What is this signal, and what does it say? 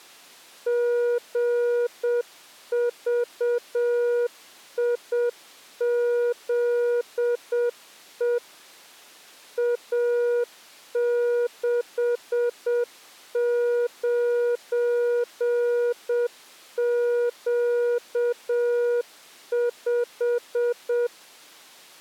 Morse code, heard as a keyed tone, machine-sent, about 7 wpm, 480 Hz. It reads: GVIZE A69Q5